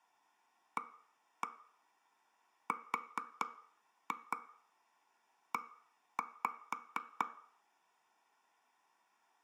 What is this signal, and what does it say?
Tap code, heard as taps on a table, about 4 knocks a second, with room echo. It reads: ARE